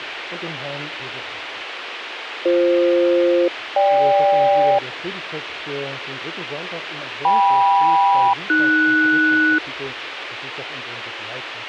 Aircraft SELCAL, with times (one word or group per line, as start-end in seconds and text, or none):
2.5-4.8 BF-GK
7.2-9.6 KM-AS